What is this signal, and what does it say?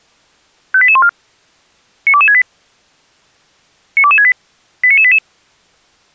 Five-tone selective call (ZVEI), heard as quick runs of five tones, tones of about 70 ms. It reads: 58814 92268 92268 89988